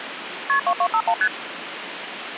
Multi-frequency trunk signalling (R1, as on North American trunks), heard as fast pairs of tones, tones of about 70 ms, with phone line noise. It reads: KP 2251 ST